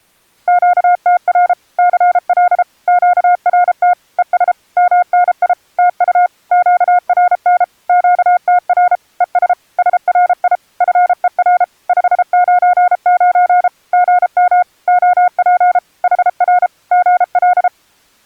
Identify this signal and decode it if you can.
Morse code, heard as a keyed tone, machine-sent, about 33 wpm, 720 Hz. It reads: QTR CL QRT ES MNI TU QRN QTR ES SRI FER 599 GM OP HR GL